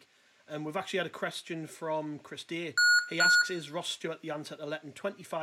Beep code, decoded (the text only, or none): 2 short